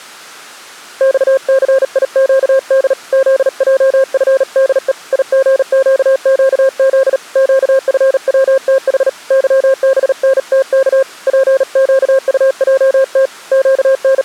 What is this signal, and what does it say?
Morse code, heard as a keyed tone, hand-sent with a paddle, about 38 wpm, 530 Hz. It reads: XCIQD ZJFDE IGQQZ QFWTH YBNTK PQUJT …